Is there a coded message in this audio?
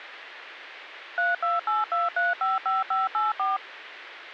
Yes: DTMF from 1.2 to 3.6 s, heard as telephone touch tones, dialled by machine, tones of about 170 ms. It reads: 3282355584